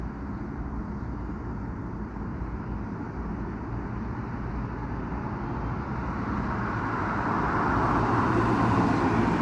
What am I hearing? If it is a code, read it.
Street noise. There is no code.